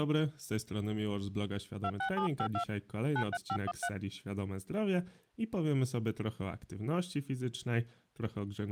DTMF, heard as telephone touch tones, dialled by hand, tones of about 70 ms, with speech in Polish. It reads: 26752 93513